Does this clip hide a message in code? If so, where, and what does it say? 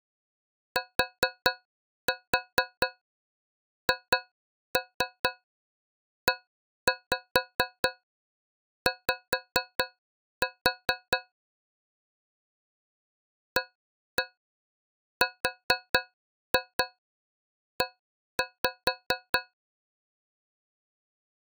Yes: tap code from 0.8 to 19.5 s, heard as taps on a metal pipe, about 4 knocks a second. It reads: THEY ARE